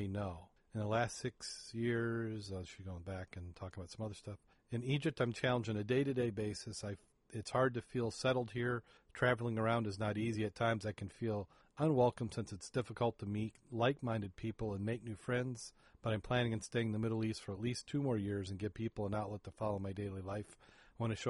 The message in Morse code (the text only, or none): none